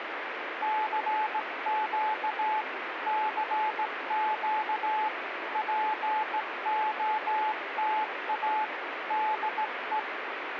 Morse code, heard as a keyed tone, hand-sent with a straight key, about 17 wpm, 860 Hz, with radio static. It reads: CQ CQ POTA DE